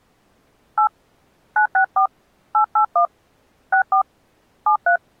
DTMF, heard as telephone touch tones, dialled by hand, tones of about 100 ms. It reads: 8 964 881 64 73